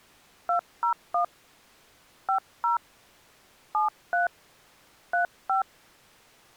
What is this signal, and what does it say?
DTMF, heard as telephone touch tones, dialled by hand, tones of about 120 ms. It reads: 201 50 73 35